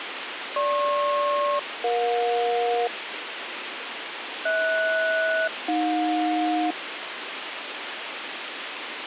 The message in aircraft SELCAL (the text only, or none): GP-EJ HS-AJ